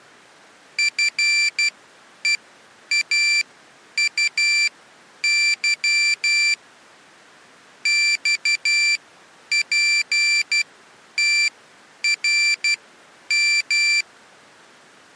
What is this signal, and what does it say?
Morse code, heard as a high beeper, machine-sent, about 12 wpm, spaced as for 9 wpm, 2350 Hz. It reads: FEAUY XPTRM